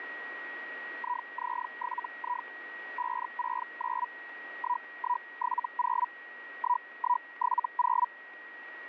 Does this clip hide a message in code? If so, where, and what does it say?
Yes: Hellschreiber (Feld-Hell, 122.5 baud) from 1.0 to 8.1 s, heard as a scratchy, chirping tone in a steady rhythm, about 980 Hz, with radio static and a steady whistle near 1900 Hz. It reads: IZ7I 569 1170 1170